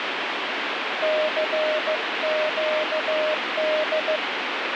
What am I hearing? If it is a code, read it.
Morse code, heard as a keyed tone, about 15 wpm, 620 Hz, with heavy radio static. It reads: CQD